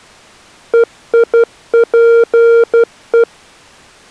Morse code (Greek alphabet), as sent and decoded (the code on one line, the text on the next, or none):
. .. .--. .
ΕΙΠΕ